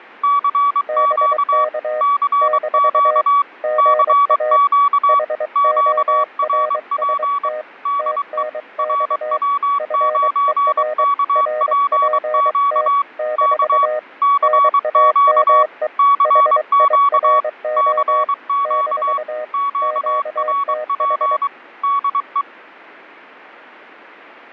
Morse code, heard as two keyed tones. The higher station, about 23 wpm, 1130 Hz: CQ CQ CQ QRP DE RW9KPQ K CQ CQ CQ QRP DE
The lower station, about 23 wpm, 620 Hz: BK - GA HORST TNX FER RPT - NAME HIRO - QTH